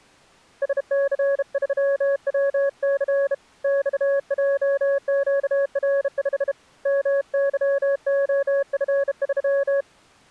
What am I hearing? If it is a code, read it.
Morse code, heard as a keyed tone, hand-sent with a bug key, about 32 wpm, 560 Hz. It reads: SC3WC XJQR5 MYOF3